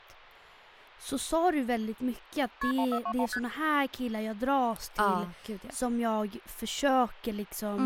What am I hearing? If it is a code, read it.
Multi-frequency trunk signalling (R1, as on North American trunks), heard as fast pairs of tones, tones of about 70 ms, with speech in Swedish. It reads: KP 1421 ST